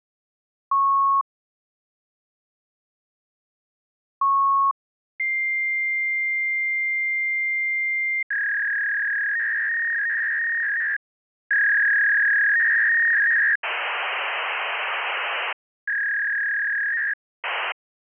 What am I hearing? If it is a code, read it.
Fax machine handshake, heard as beeps, a long tone, a warble and hiss.